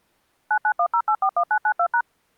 DTMF, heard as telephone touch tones, dialled by machine, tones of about 70 ms. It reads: 9910841992#